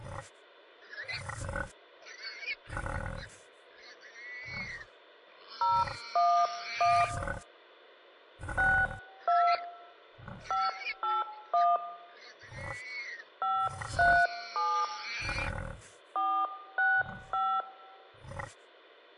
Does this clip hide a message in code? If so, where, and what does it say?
Yes: DTMF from 5.6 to 17.6 s, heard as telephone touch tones, dialled by hand, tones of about 250 ms. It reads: 011 62 581 537 465